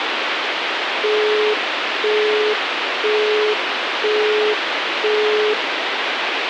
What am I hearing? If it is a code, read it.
Telephone call progress tone (single-tone plan, as in Europe, Japan and elsewhere), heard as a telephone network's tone, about 420 Hz, 0.5 s on and 0.5 s off, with phone line noise. Busy tone.